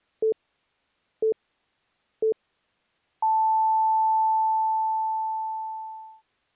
Radio time signal (three low pips and a long one an octave up, as on NHK), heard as pips.